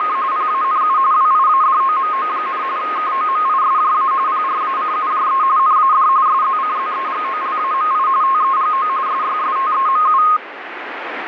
RTTY (45.45 baud, 170 Hz shift), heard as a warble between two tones, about 1160 Hz centre, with radio static. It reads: … PANU WIADOMO, KOMISJA PRACUJE NAD SZCZEGOLAMI TEGO SYSTEMU